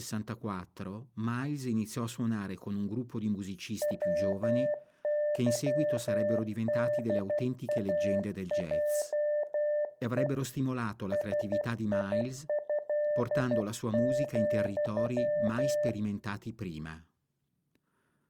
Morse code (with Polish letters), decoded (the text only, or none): WYDAJE SIĘ,